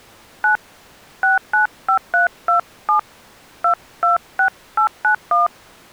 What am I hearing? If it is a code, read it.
DTMF, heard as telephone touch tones, dialled by hand, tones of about 120 ms. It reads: 9 695327 226891